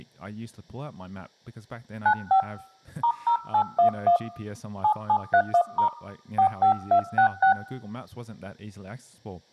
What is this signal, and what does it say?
DTMF, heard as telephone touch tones, dialled by hand, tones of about 90 ms, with speech in English. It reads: 95 *0811 7731* 45266